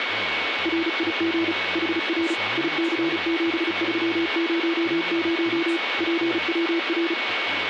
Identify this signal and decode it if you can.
Morse code, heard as a keyed tone, machine-sent, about 35 wpm, 330 Hz, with radio static, a steady whistle near 2220 Hz and speech in English. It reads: RIG HR IC7300 PWR